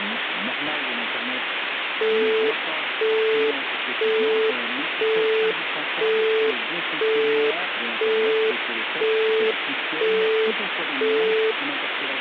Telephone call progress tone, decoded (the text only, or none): busy tone